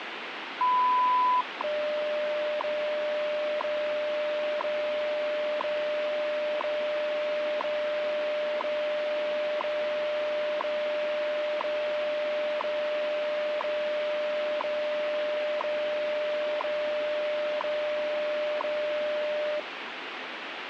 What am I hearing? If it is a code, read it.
Radio time signal (WWV, Colorado), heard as ticks, one a second, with radio static.